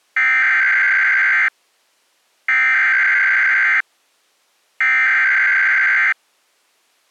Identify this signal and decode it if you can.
Emergency Alert System (SAME) tones (header bursts), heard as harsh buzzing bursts, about 520.83 baud.